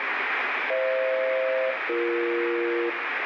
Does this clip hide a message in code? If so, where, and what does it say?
Yes: aircraft SELCAL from 0.7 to 2.9 s, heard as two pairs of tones, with radio static and room echo. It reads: FH-BE